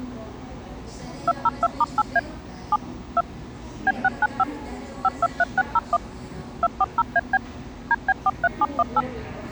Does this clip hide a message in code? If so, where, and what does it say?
Yes: DTMF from 1.3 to 9.0 s, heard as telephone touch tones, dialled by machine, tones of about 40 ms, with the noise of a cafe. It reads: 202*8A 7 2 B695 523601 240AB DB43718